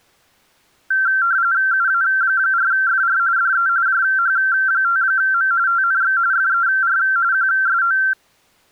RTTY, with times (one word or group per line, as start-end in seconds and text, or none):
1.7-3.2 UA4FR
3.4-3.7 DE
3.9-5.5 JH5M
5.7-6.2 TNX
6.3-7.0 FER
7.3-8.0 QSO